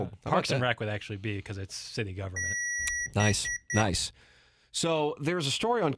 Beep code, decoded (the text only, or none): 1 long, 3 short